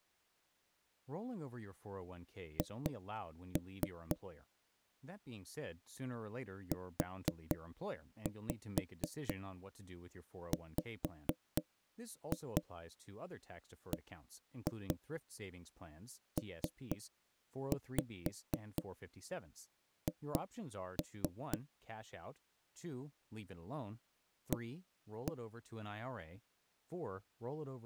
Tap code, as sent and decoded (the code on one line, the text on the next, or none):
2-3 / 4-5 5-2 1-2 3-5 2-3 / 1-1
H UWBPH A